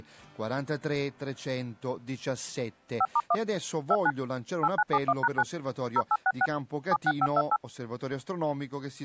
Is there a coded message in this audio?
Yes: DTMF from 3.0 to 7.6 s, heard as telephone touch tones, dialled by machine, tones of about 50 ms. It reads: 5*1 29 8971#9 0866 76528